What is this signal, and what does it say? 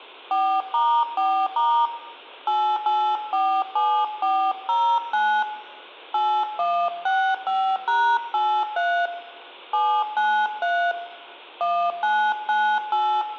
DTMF, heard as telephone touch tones, dialled by hand, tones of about 290 ms, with room echo. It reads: 4*4* 8847409 8165#83 793 1998